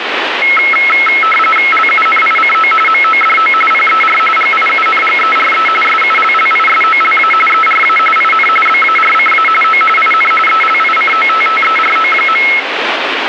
RTTY (45.45 baud, 850 Hz shift), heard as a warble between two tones, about 1750 Hz centre, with radio static. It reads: LUNICO MODO PER GIUNGERE SULLISOLA ERA IN BARCA O IN ELICOTTERO.